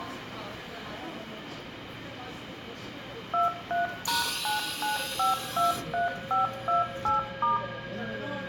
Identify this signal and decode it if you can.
DTMF, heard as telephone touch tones, dialled by machine, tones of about 140 ms, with room echo and the noise of a subway station. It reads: 23#99523528*